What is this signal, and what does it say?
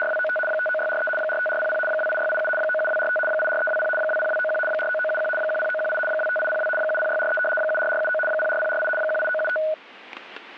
RTTY (75 baud, 850 Hz shift), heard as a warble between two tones, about 1050 Hz centre, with static crashes. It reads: … 59643 45400 28687 97245 84320 20291 49971 10918 25802 70643 74479 04048 18975